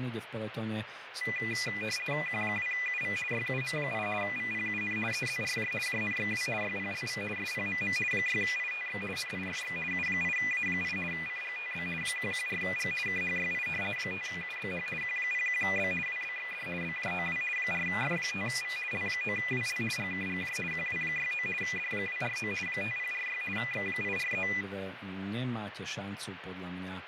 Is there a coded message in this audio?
Yes: RTTY (50 baud, 450 Hz shift) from 1.2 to 24.6 s, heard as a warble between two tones, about 2200 Hz centre, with radio static, fading and speech in Slovak. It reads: Q2UV YUM8 VPUN EZRJ JNXW YPLV SPMM 6ITX NIFX U8A8 CGTB 114G KHYI 5UBH Q01B WBXD BJOW 4F5V L9WL GKGJ QW69 D249 5046 X843